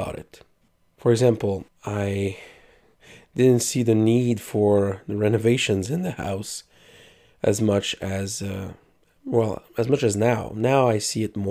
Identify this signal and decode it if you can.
Speech in English. There is no code.